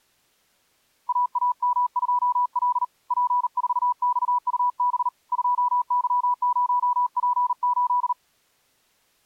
Morse code, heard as a keyed tone, hand-sent with a paddle, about 39 wpm, 980 Hz. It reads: AAM2L P4XUB 2Y0P8